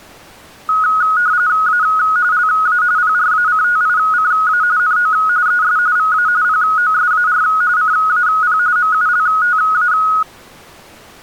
RTTY (45.45 baud, 170 Hz shift), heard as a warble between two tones, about 1360 Hz centre. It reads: A LA PRACTICA NO ES VA POSAR CAP MULTA